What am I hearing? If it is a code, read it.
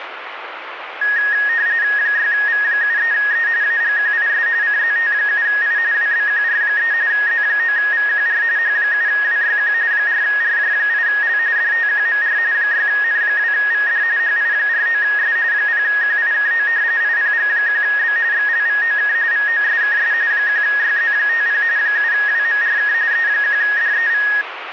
RTTY (45.45 baud, 170 Hz shift), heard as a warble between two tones, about 1750 Hz centre, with radio static. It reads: 6V73E AGQIS CZT7I WBQR3 Z9VQR H7WYQ 4RJ8L DTQMR 6N2VD HI49S 0QIKO IPG1B XLVOK VOSKS 1YZ50 7WMRK E1DEV